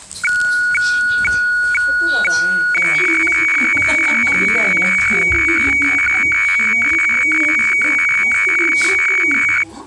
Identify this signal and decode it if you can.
Weather fax (radiofax), 120 lines a minute, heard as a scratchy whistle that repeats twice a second, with the noise inside a lift.